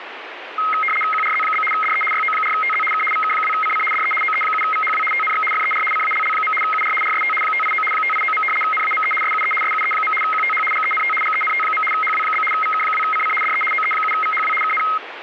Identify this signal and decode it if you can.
RTTY (75 baud, 850 Hz shift), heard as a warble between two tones, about 1700 Hz centre, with radio static. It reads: QRZ? DE YO4TZ K VK2CC DE OE7VHW TNX FER CALL. UR RST 589 589. NAME SUE SUE. QTH GENT GENT. HW? VK2CC DE OE7VHW KN